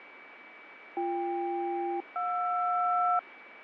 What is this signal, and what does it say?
Aircraft SELCAL, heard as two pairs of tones, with radio static and a steady whistle near 2290 Hz. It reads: BK-JR